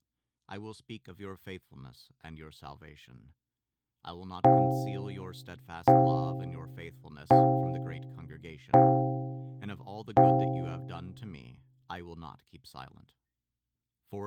Clock strike, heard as a bell, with speech in English. 5. Five o'clock.